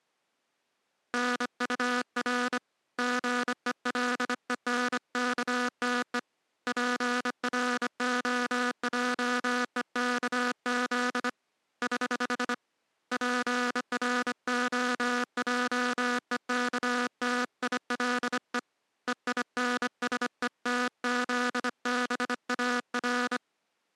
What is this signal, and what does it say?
Morse code, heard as a buzzer, hand-sent with a bug key, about 25 wpm. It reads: NUR GELENKTE PROJEKZ <HH> PROJEKTILE EINSETZBAR